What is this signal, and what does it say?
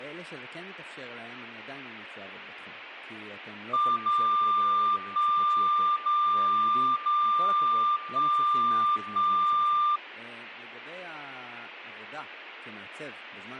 Radio time signal (DCF77), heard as a tone whose level steps once a second, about 1190 Hz, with speech in Hebrew. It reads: 0 1 0 0 1 1